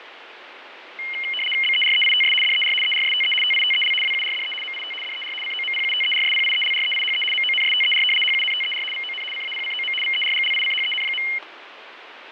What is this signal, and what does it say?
RTTY (75 baud, 850 Hz shift), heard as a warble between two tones, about 2550 Hz centre, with radio static and fading. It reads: BEREITS DER ERSTE TITEL WURDE MIT DER COMPUTERSPIELREIHE MONSTER HUNTER VON CAPCOM VERGLICHEN.